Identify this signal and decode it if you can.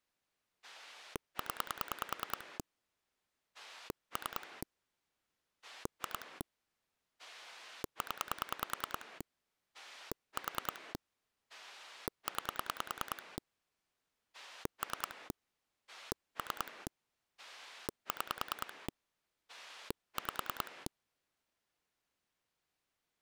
Pulse dialling, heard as a rotary dial, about 10 pulses a second. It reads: 0 3 2 0 4 9 3 3 6 5